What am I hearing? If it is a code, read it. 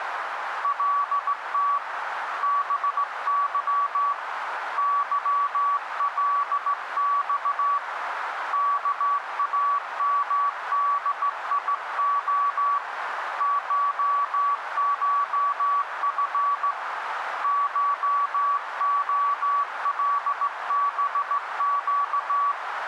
Morse code (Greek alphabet), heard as a keyed tone, hand-sent with a straight key, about 16 wpm, 1140 Hz, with radio static and a narrow filter. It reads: ΛΤ ΒΥ ΥΛΞ ΚΑΜΔΙΟ ΧΧΦ ΧΟΛΒΨ